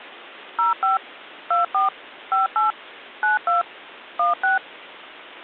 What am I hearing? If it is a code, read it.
DTMF, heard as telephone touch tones, dialled by machine, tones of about 140 ms. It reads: 05 24 58 92 16